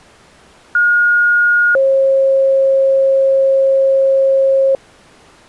Two-tone page, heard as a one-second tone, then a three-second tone, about 1430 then 540 Hz.